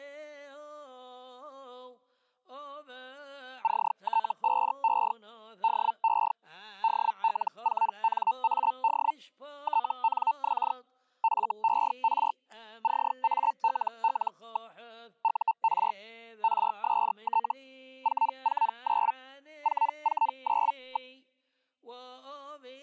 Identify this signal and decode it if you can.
Hellschreiber (Feld-Hell, 122.5 baud), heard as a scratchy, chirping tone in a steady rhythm, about 900 Hz. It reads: CT5E DE DL4NAD TNX FER CALL. UR RST 449 449.